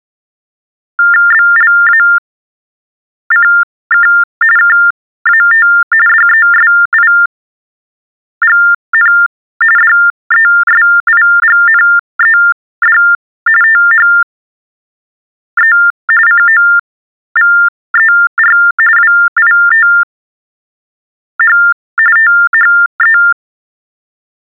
TTY/TDD text telephone tones (45.45 baud Baudot), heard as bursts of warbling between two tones, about 400 Hz shift, 1600 Hz centre. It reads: BLACK KAT DESIGN DESIGNED THE COVER WITH THE